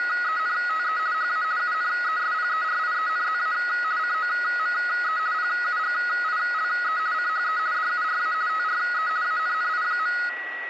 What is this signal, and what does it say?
RTTY (50 baud, 170 Hz shift), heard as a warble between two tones, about 1360 Hz centre, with radio static and a steady whistle near 1930 Hz. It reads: … HA UNESPERIENZA COME PUGILE CHE DURA TRE ANNI.